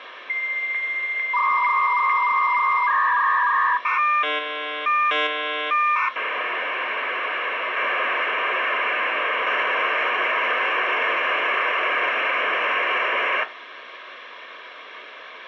Dial-up modem handshake (V.34 or later), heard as a whistle, warbles, then hiss, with phone line noise.